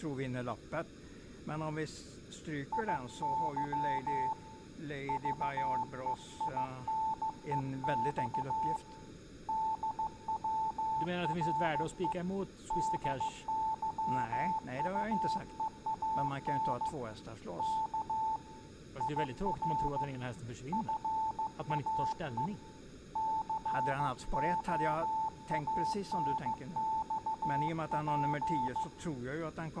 Morse code, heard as a keyed tone, hand-sent with a paddle, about 15 wpm, 880 Hz, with room echo and speech in Swedish. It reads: IY VEINEX DWRE DYUEAN K IR FAE COANXP